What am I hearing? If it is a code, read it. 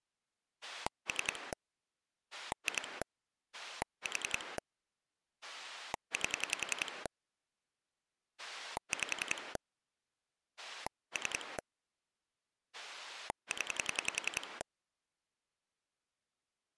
Pulse dialling, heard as a rotary dial, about 10 pulses a second. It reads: 3 2 4 8 5 3 0